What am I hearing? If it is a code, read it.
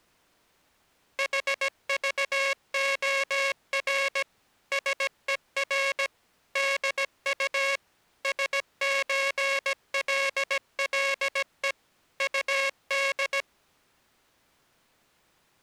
Morse code (with Danish letters), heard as a buzzer, machine-sent, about 17 wpm. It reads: HVOR SER DU SØLLE UD